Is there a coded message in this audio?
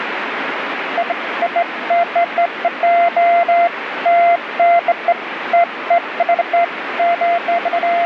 No, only beeps of irregular length, with radio static.